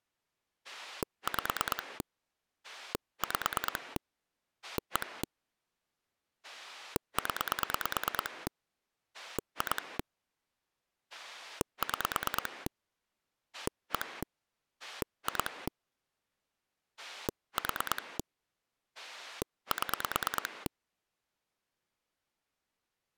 Pulse dialling, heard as a rotary dial, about 9 pulses a second. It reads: 5 5 1 0 2 6 1 2 4 7